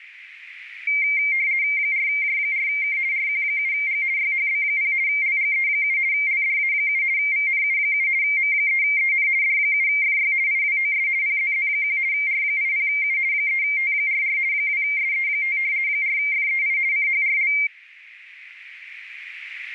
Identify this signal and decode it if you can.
RTTY (50 baud, 170 Hz shift), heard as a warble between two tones, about 2200 Hz centre, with radio static. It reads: 4J4K RQ7G YHB0 LGE7 LDA7 VNU7 M3EN D7FY IWOS PZZ1 R80U 3T44 2SE5 4FEI CHRL